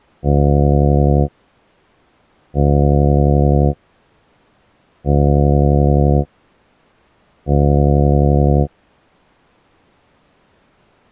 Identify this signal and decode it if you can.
Ship horn signal, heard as a ship's horn, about 70 Hz. 4 short. At sea: a pilot vessel's identity signal in fog.